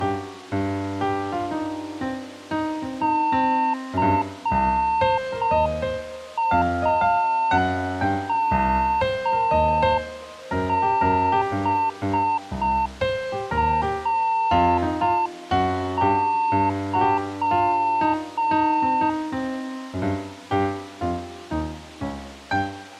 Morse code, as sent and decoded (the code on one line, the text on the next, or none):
-.-. .- -- -... .-. -.--
CAMBRY